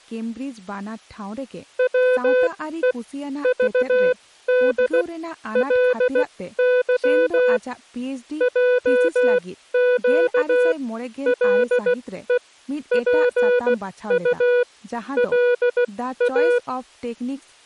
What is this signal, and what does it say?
Morse code (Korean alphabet), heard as a keyed tone, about 16 wpm, spaced as for 13 wpm, 500 Hz, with speech in Santali. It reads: 바르게 해가지고